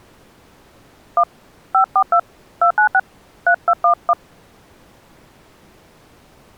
DTMF, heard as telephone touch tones, dialled by hand, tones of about 70 ms. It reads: 1 542 296 3211